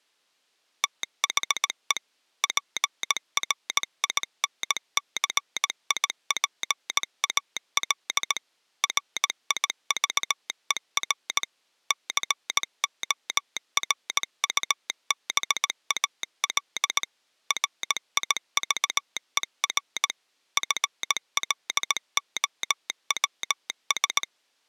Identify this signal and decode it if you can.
Morse code, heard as a telegraph sounder, machine-sent, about 18 wpm. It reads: THE PRINCIPAL RIVER CORUBAL RIVER FLOWS